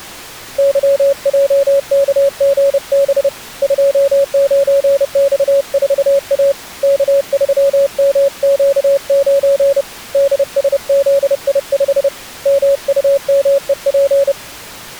Morse code, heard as a keyed tone, hand-sent with a paddle, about 30 wpm, 560 Hz. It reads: YJKGB 29X4A K3MQ9 DSZI5 MUMEP